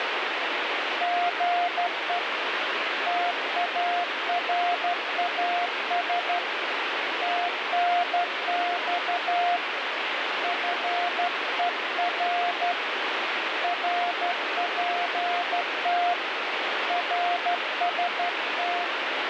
Morse code, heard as a keyed tone, hand-sent with a straight key, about 12 wpm, 700 Hz, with heavy radio static. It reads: GE TARAS TNX FER RPT RST